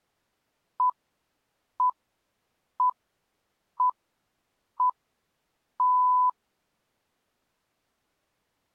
Radio time signal (six pips, as the Greenwich Time Signal), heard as pips.